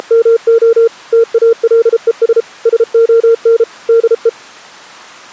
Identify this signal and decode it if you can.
Morse code, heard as a keyed tone, machine-sent, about 33 wpm, 460 Hz. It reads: … TALES SON DE